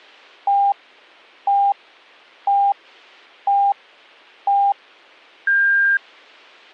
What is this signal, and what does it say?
Radio time signal (five pips and a higher one, as on Chinese radio), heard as pips.